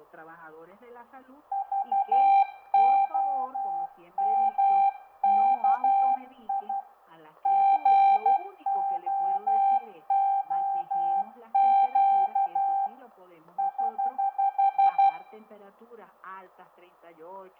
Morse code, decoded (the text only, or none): VOMKI GOOQ <HH>